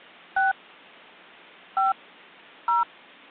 DTMF, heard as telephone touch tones, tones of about 150 ms. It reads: 6 5 0